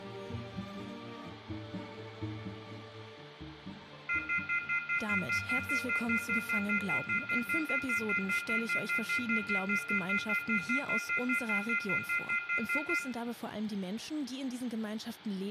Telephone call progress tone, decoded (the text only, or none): off-hook warning tone